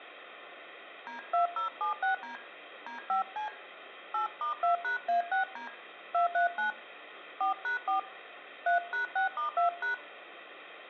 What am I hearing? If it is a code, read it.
DTMF, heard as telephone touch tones, dialled by hand, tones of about 120 ms, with room echo. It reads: D2076D D5C 8*2#A6D 239 4#4 3#6*2#